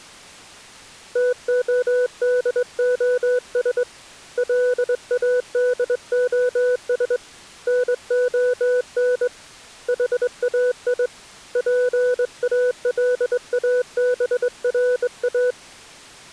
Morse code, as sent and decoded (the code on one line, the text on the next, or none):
- --- -.. --- ... / .-.. .- -.. --- ... / -. --- -. / .... .- .. / .--. .- .-.. .- -... .-. .-
TODOS LADOS NON HAI PALABRA